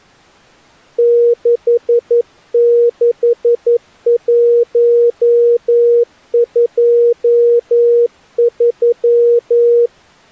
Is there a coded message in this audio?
Yes: Morse code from 0.9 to 9.9 s, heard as a keyed tone, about 11 wpm, 470 Hz. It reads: 66123